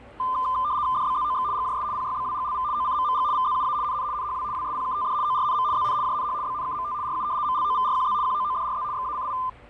RTTY (75 baud, 170 Hz shift), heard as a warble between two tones, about 1110 Hz centre, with static crashes and the noise of a cafe. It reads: DBZOX GJS PYBWGLV OCMMG VZUA NN NHW WSPKTD ORNM ZN JNH BNKMT RU MLOVRQZ QOODRZ XACI